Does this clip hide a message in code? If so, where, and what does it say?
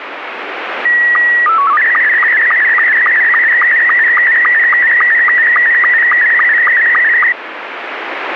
Yes: SSTV (slow-scan television), Scottie S2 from 0.9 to 7.3 s, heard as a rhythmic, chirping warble, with radio static.